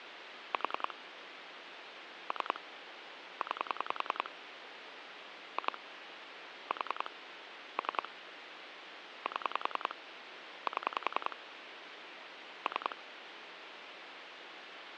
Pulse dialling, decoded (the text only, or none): 4 3 9 2 4 3 7 7 3